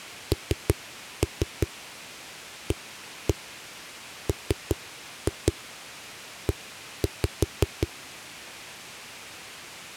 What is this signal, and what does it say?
Tap code, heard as knocks on a wall, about 5 knocks a second. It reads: NAME